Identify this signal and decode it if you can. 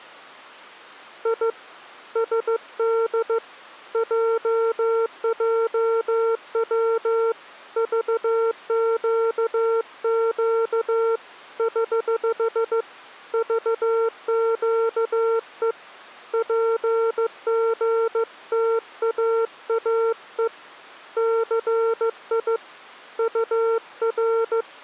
Morse code, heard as a keyed tone, hand-sent with a paddle, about 15 wpm, 450 Hz. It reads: I SD JJW VQQ <HH> VQE PGTAAE CI UR